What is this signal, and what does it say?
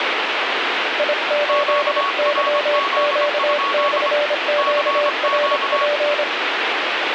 Morse code, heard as two keyed tones, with radio static. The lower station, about 26 wpm, 590 Hz: I8YQ/QRP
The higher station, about 25 wpm, 1120 Hz: QRZ? CQ